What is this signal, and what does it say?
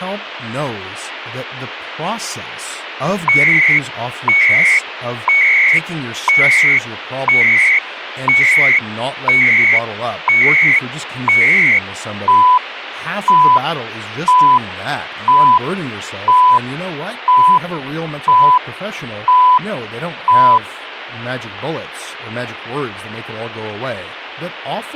Radio time signal (CHU, Canada), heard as beeps and data bursts, one a second, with radio static and speech in English.